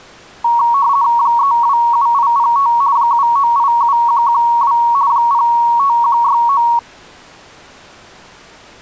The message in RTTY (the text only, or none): 327805 7987112 05169